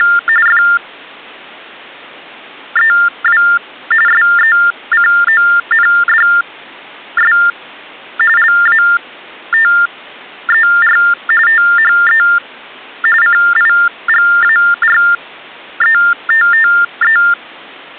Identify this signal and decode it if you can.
TTY/TDD text telephone tones (45.45 baud Baudot), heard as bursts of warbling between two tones, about 400 Hz shift, 1600 Hz centre. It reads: … FEW SECONDS LATER THE CIGARETTE